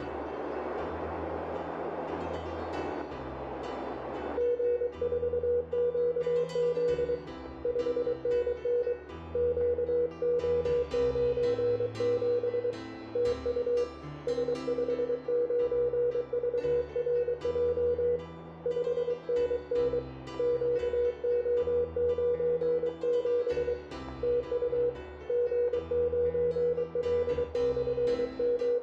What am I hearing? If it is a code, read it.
Morse code, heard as a keyed tone, hand-sent with a paddle, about 23 wpm, 480 Hz, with radio static, static crashes and room echo. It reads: G4QZ 5NN QO97 TU S59VRJ 5NN QO97 TU …